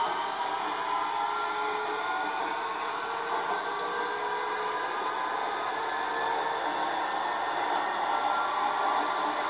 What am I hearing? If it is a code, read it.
The noise inside a subway train. There is no code.